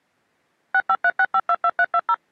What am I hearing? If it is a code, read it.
DTMF, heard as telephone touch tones, dialled by machine, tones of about 60 ms. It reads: 6536522320